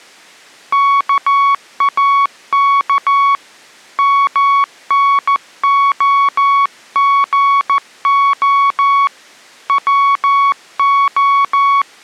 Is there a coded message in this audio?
Yes: Morse code (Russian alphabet) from 0.7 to 11.9 s, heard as a keyed tone, hand-sent with a paddle, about 14 wpm, 1120 Hz. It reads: КАК МНОГО ВО